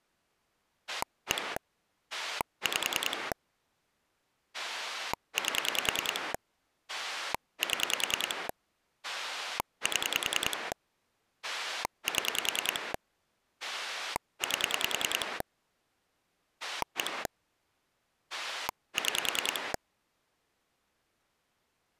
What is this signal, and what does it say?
Pulse dialling, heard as a rotary dial, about 10 pulses a second. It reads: 1 5 8 7 7 7 8 1 6